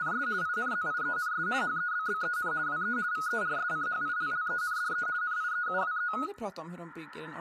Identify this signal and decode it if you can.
RTTY (50 baud, 170 Hz shift), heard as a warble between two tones, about 1360 Hz centre, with room echo and speech in Swedish. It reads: … INZIENS HEBBEN WE VERSCHILLENDE NIEUWE